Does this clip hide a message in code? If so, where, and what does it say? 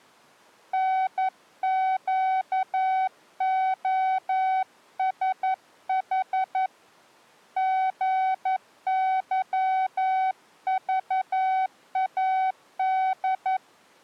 Yes: Morse code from 0.7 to 13.6 s, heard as a keyed tone, hand-sent with a paddle, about 11 wpm, 760 Hz. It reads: NQOSH GYVAD